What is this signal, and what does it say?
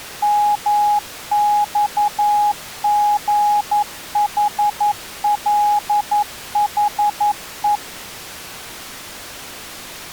Morse code, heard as a keyed tone, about 11 wpm, 830 Hz. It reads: MXGHLHE